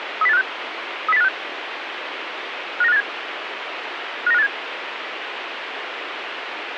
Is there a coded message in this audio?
Yes: five-tone selective call (EEA) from 0.2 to 4.5 s, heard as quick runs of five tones, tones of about 40 ms, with radio hiss. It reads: 30856 30856 59587 59587